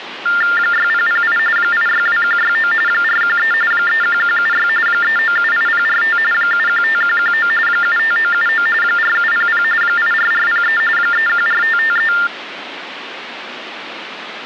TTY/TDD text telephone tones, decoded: 6008 862169 413 31176 3978045 715119 75979 4700 84403 314553

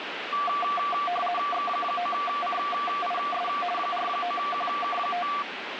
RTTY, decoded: X9CIS 49QK5

